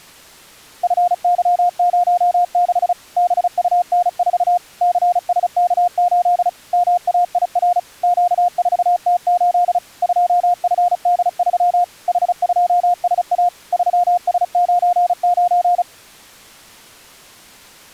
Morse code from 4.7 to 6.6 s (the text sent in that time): CSK8